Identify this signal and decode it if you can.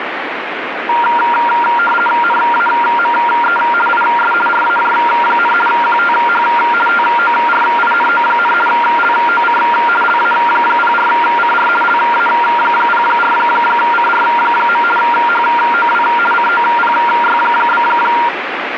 RTTY (50 baud, 450 Hz shift), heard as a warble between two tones, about 1170 Hz centre, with radio static. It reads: NAME IS RAJ, QTH TORINO, LOC LA04CR LA04CR. HOW COPY?